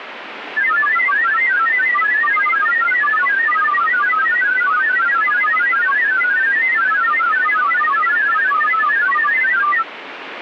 Multi-tone FSK (Olivia or MFSK type), about 1000 Hz wide, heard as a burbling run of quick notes, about 31.25 baud, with radio static.